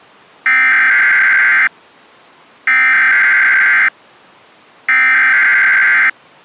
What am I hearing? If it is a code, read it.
Emergency Alert System (SAME) tones (header bursts), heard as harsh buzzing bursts, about 520.83 baud.